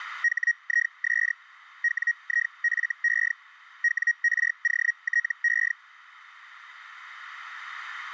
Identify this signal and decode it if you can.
Hellschreiber (Feld-Hell, 122.5 baud), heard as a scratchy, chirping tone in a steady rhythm, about 1900 Hz. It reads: HIS WIFE WROTE